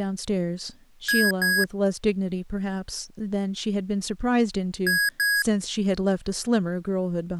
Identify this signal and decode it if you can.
Beep code, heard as beeps from a small speaker, played twice, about 1650 Hz, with speech in English. 2 short. In AMI BIOS tables: memory parity error; in IBM BIOS tables: self-test error shown on screen; in Dell tables: no memory detected.